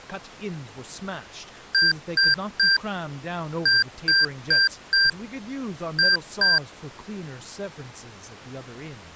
Beep code, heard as beeps from a small speaker, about 1600 Hz, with speech in English. 3-4-2.